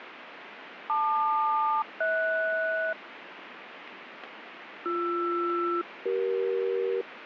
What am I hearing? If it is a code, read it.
Aircraft SELCAL, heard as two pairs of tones, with radio static. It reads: LQ-HS BR-CE